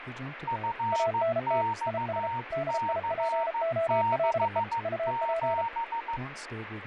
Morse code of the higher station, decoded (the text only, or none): FXC67